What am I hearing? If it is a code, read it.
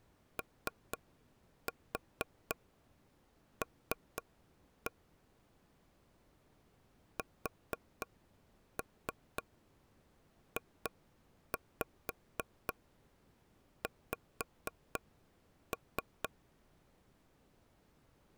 Tap code, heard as taps on a table, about 4 knocks a second. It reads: OL SJX